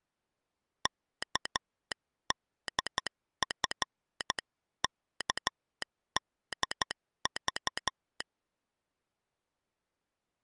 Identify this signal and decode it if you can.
Morse code (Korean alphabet), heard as a telegraph sounder, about 12 wpm. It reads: 은을